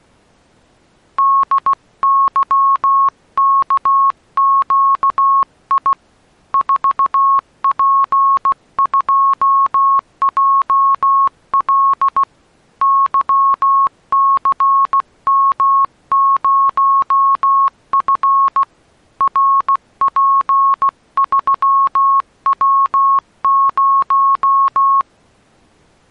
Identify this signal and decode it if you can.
Morse code, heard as a keyed tone, hand-sent with a paddle, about 16 wpm, 1090 Hz. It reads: DYKQI 4P2JL YCM0F RP3W0